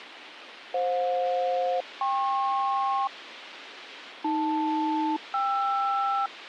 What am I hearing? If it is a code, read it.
Aircraft SELCAL, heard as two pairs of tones, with radio hiss. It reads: FJ-KP AL-KR